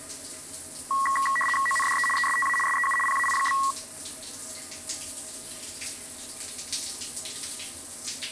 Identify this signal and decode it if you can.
RTTY (75 baud, 850 Hz shift), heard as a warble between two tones, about 1500 Hz centre, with the noise of a restroom. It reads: ONDE ESTA SEU PAI?